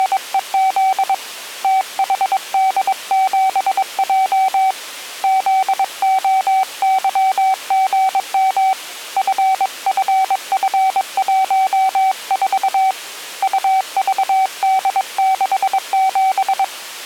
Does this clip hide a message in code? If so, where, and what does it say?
Yes: Morse code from 0.0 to 16.7 s, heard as a keyed tone, hand-sent with a paddle, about 22 wpm, 760 Hz. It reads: … THD7J ZOYGM FFF14 UVD67